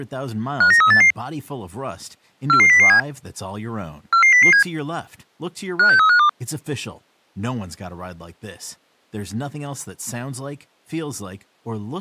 Five-tone selective call (CCIR), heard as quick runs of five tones, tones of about 100 ms, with speech in English. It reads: 59388 44007 44007 56352